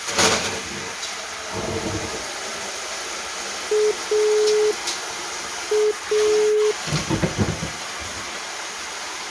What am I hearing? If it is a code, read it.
Telephone call progress tone (pulsed, as in Italy), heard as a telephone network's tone, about 420 Hz, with kitchen noise. Dial tone.